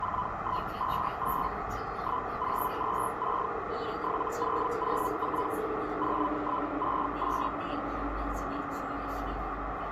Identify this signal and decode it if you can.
Hellschreiber (Feld-Hell, 122.5 baud), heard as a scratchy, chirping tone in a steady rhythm, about 1000 Hz, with radio static, a narrow filter and the noise inside a subway train. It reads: 4158 1026 7004 0168